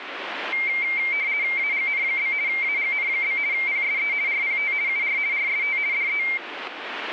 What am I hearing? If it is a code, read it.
RTTY (50 baud, 170 Hz shift), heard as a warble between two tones, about 2200 Hz centre, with radio static. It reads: AGN? AGN? PSE RPT UR RST DE